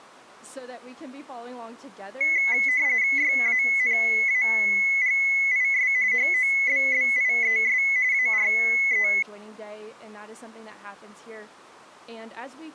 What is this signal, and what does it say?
RTTY (45.45 baud, 170 Hz shift), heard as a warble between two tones, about 2100 Hz centre. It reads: YANAGIS HOBBIES ARE